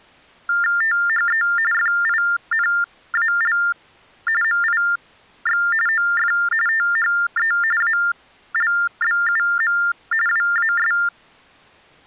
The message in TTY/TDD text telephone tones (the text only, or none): THE FINAL MIX OF THE ALBUM WAS